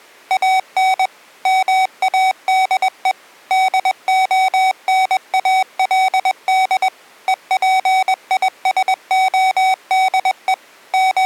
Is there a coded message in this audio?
Yes: Morse code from 0.2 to 11.3 s, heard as electronic beeps, machine-sent, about 21 wpm, 760 Hz. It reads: AN MADE DONALD EPISODE …